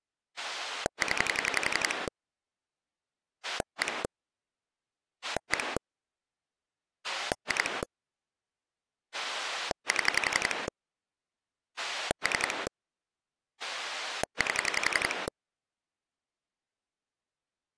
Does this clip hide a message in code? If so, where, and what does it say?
Yes: pulse dialling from 0.4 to 15.3 s, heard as a rotary dial, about 11 pulses a second. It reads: 0 1 1 2 7 3 8